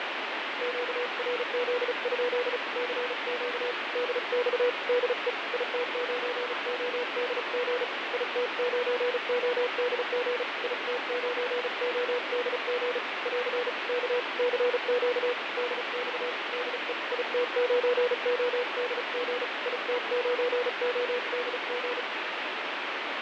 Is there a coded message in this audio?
Yes: Morse code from 0.6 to 22.1 s, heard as a keyed tone, hand-sent with a paddle, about 35 wpm, 490 Hz, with heavy radio static and fading. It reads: QRZ? CQ DX DE IT9ODG IT9ODG IT9ODG <AR> K CQ DX DE IT9ODG IT9ODG